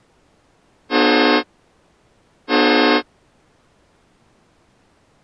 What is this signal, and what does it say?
Train horn signal, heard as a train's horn. 2 short. On North American railways: a signal is acknowledged.